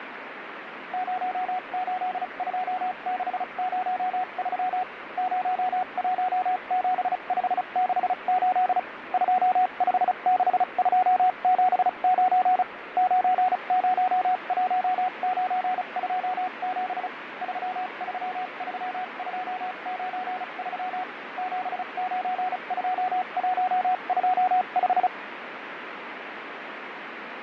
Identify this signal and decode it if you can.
Morse code, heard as a keyed tone, machine-sent, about 35 wpm, spaced as for 30 wpm, 740 Hz, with radio static and fading. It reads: 082603 017568 256279 901927 333293 792125